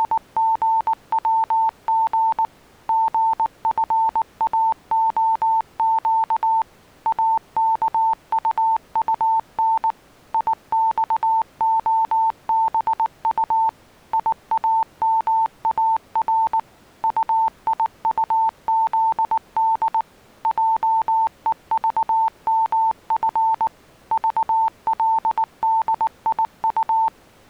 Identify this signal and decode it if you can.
Morse code, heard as a keyed tone, machine-sent, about 19 wpm, 890 Hz. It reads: … GFAOQ AKUUN IXOBU IAMAR UIUZD JEVMF VLDIU